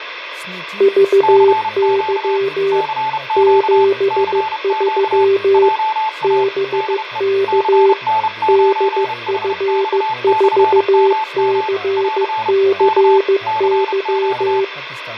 Morse code, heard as two keyed tones, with radio static, fading, room echo and speech in Bodo. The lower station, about 15 wpm, 390 Hz: VY 73 BK DF4CCY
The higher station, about 31 wpm, 870 Hz: CQ CQ CQ JA DE CN9HX/MM <AR> K CQ